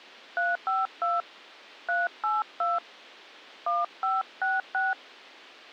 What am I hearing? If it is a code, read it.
DTMF, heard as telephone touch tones, dialled by hand, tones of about 180 ms. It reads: 352 382 1566